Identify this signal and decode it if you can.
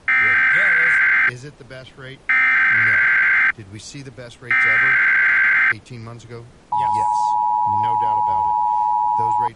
Emergency Alert System (SAME) tones (header bursts, then the 853 and 960 Hz attention tone), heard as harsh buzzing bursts, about 520.83 baud, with speech in English.